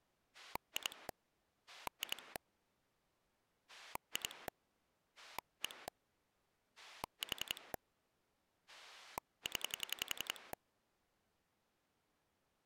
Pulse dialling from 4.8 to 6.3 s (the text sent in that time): 1